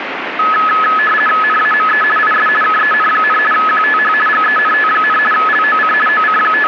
RTTY (50 baud, 450 Hz shift), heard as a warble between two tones, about 1500 Hz centre, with radio static. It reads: NAME IS KEN, QTH GENT, LOC …